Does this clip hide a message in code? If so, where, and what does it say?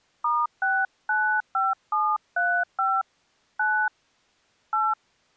Yes: DTMF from 0.2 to 4.9 s, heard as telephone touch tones, dialled by hand, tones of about 250 ms. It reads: *695735 9 8